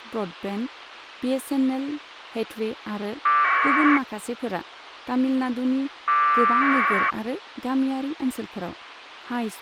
Packet radio (AX.25, as in APRS), 1200 baud, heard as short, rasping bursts, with radio hiss and speech in Bodo.